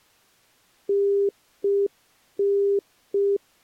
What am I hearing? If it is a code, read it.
Telephone call progress tone (UK plan), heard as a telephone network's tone, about 400 Hz. Congestion tone.